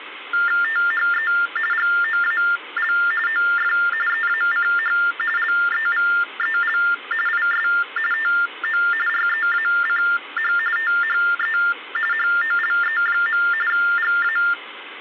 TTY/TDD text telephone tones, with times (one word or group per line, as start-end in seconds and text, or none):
0.6-1.3 THE
1.7-2.9 GOAL
3.3-3.7 OF
4.1-5.0 EACH
5.4-6.8 LEVEL
7.3-7.7 IS
8.1-8.8 TO
9.1-10.5 REACH
10.8-11.6 THE
12.1-13.4 HOLE.
13.7-14.4 GA